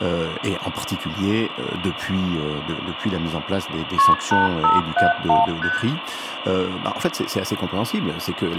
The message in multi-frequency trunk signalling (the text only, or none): KP 8571 ST